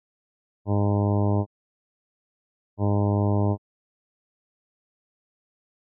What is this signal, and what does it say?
Ship horn signal, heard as a ship's horn, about 100 Hz. 2 short. At sea: I am altering course to port.